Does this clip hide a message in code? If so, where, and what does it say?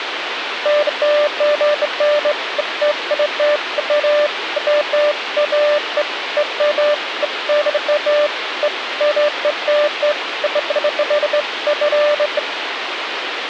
No, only beeps of irregular length, with radio hiss.